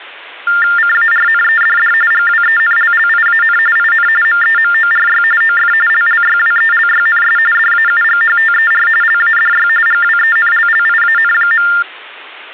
TTY/TDD text telephone tones (45.45 baud Baudot), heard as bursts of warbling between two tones, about 400 Hz shift, 1600 Hz centre. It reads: CARNEDD GWENLLIAN IN MEMORY OF LLYWELYNS DAUGHTER LADY GWENLLIAN.